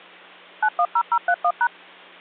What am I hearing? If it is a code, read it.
DTMF, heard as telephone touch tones, dialled by machine, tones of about 60 ms, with hum. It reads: 910031#